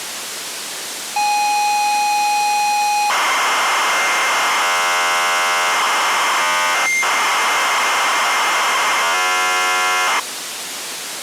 ZX Spectrum tape loading, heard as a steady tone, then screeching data, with tape hiss.